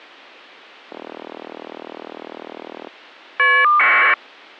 Caller ID data burst, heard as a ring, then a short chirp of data, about 1200 baud.